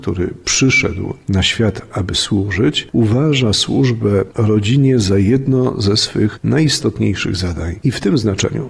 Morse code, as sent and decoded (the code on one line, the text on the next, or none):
none